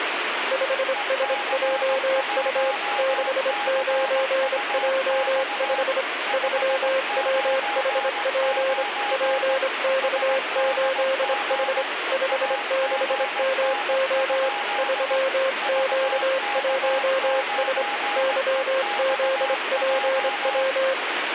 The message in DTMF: none

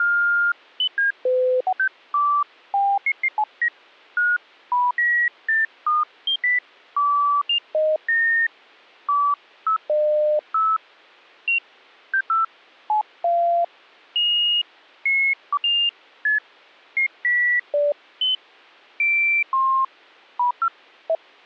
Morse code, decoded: none

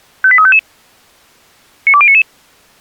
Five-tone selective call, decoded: 58355 92099

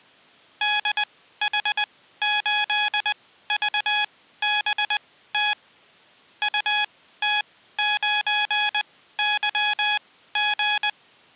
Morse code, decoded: DH8VBT UT9YG

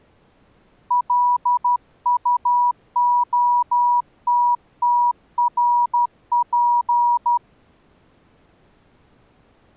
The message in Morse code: LUOTTRP

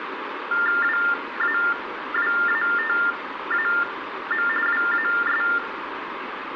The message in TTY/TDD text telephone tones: WAWATAM WAS

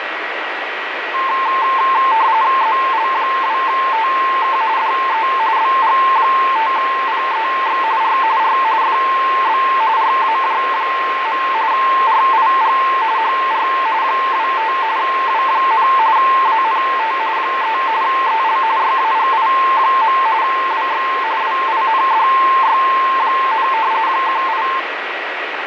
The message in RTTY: ZL2TK DE BG5PEX R R FB RAJ. RIG HR 25 W, ANT 3 EL YAGI. WX WINDY, 18

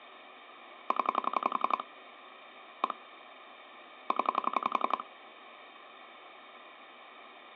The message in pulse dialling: 0 1 0

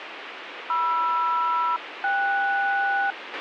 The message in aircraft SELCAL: MR-KS

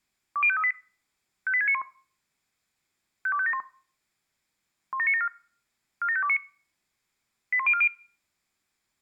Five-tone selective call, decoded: 20538 58691 52571 17974 47529 81040

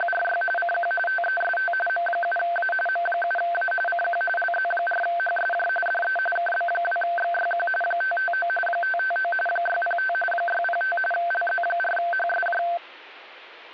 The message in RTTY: … CQ TEST M7A M7A CQ LZ4HSJ DE KB2XYQ 559 559 605 605 LZ4HSJ

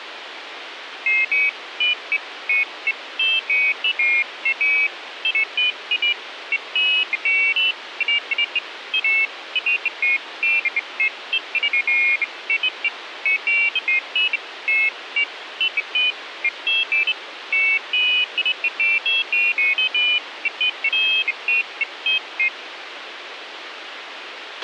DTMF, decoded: none

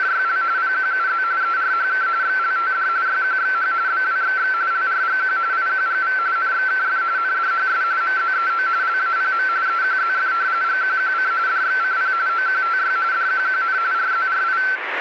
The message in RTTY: … PQUZ ERHK XLTD YQXH BWXX LRGQ IQGV NXKF NDHS MZEO LAPM EQZF GQQC DXCP OQTY DQQN RZRI

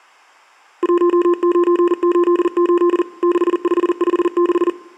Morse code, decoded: 1988 6556

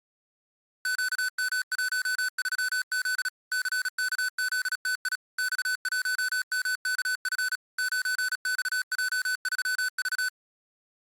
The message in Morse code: QM13Z CKZTI X1MKF 9XJ3V

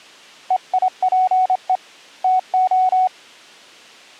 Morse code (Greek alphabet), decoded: ΕΙΠΕ ΤΟ

